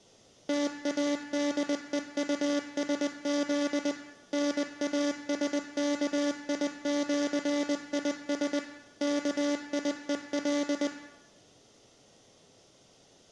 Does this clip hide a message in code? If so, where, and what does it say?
Yes: Morse code (with Esperanto letters) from 0.4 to 10.9 s, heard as a buzzer, machine-sent, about 20 wpm, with room echo. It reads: TADEUSZ NASKIĜIS KIEL